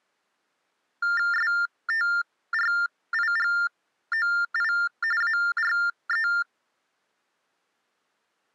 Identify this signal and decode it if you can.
TTY/TDD text telephone tones (45.45 baud Baudot), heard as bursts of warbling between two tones, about 400 Hz shift, 1600 Hz centre. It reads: STRIGOI ARE